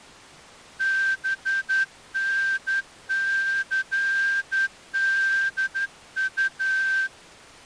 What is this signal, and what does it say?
Morse code, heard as a whistle, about 11 wpm. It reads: BNCDU